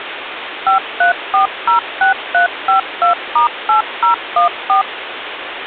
DTMF, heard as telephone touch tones, dialled by machine, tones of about 120 ms, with phone line noise. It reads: 53406352*8014